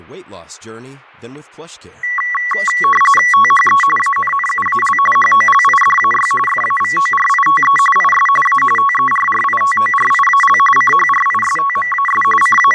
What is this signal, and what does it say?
RTTY (45.45 baud, 850 Hz shift), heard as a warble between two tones, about 1550 Hz centre, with fading, static crashes and speech in English. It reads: THE ANNUAL HOLIDAY FAVORITE IS A TERRITORIAL CHRISTMAS …